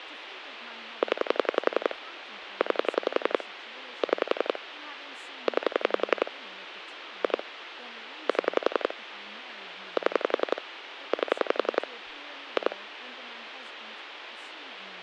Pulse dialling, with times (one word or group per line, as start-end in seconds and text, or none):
1.0-1.9 0
2.6-3.4 9
4.0-4.6 6
5.5-6.3 9
7.2-7.4 2
8.3-8.9 7
10.0-10.6 7
11.1-11.9 8
12.6-12.8 2